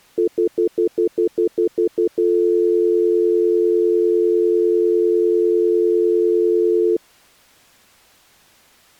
Telephone call progress tone (North American plan), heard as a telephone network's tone, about 350, 440 Hz, 0.1 s on and 0.1 s off. Stutter dial tone.